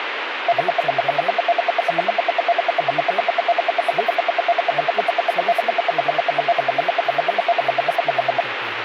Radio time signal (RWM, Moscow), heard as ten pulses a second, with radio static and speech in Hindi.